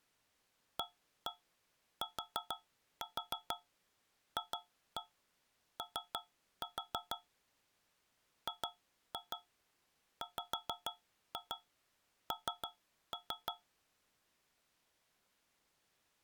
Tap code, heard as taps on a metal pipe, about 6 knocks a second. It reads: ATFO GWN